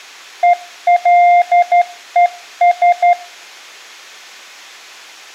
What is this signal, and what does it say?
Morse code, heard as a keyed tone, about 12 wpm, 700 Hz. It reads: ELES